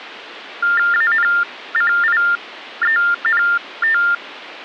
TTY/TDD text telephone tones (45.45 baud Baudot), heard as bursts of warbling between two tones, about 400 Hz shift, 1600 Hz centre. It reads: ANCIENT